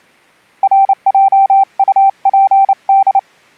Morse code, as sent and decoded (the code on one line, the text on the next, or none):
.-. .--- ..- .--. -..
RJUPD